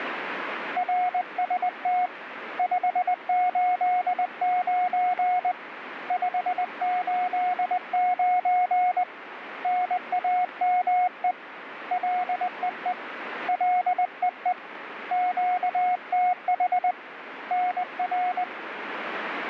Morse code, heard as a keyed tone, hand-sent with a paddle, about 20 wpm, 720 Hz, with radio static. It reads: RST 589 589 NAME LEE LEE QTH NR